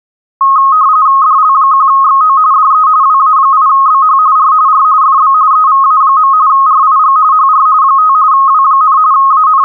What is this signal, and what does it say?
RTTY (45.45 baud, 170 Hz shift), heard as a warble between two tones, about 1170 Hz centre. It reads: DL1XO DE WA8BH R R FB EVA. RIG HR 5 W, …